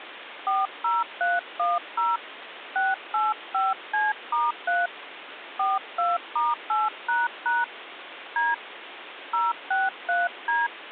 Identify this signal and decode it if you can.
DTMF, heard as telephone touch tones, dialled by hand, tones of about 190 ms, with phone line noise. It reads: 40310 685C*3 42*8## D 063D